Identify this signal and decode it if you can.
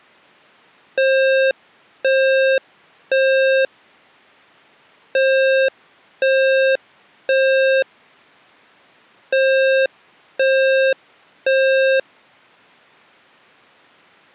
Alarm pattern, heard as an alarm's beeps, played three times, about 530 Hz. Temporal three. Smoke or fire, evacuate.